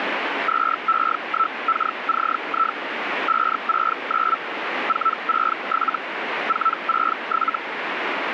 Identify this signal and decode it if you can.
Hellschreiber (Feld-Hell, 122.5 baud), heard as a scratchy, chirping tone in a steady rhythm, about 1320 Hz, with radio static. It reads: 2E1KCI 569 467 467